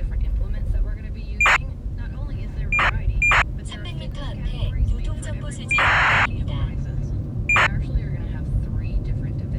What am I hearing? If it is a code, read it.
ACARS aircraft data, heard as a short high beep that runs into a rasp, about 2400 baud, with the noise inside a car.